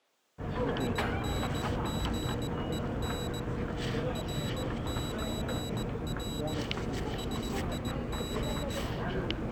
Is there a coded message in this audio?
Yes: Morse code (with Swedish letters) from 0.7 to 8.8 s, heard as a high beeper, hand-sent with a straight key, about 18 wpm, 3900 Hz, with the noise of a crowd indoors. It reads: INGEN RÖR SIG